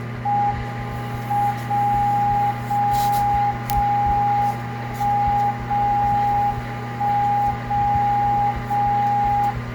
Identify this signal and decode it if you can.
Radio time signal (WWVB), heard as a tone whose level steps once a second, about 820 Hz, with static crashes, a steady whistle near 1200 Hz, room echo and kitchen noise. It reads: M 0 0 0 1 0 1 0 0